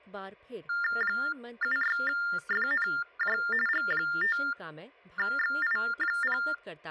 TTY/TDD text telephone tones (45.45 baud Baudot), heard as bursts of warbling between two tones, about 400 Hz shift, 1600 Hz centre, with speech in Hindi. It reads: 76FNJ G5XI0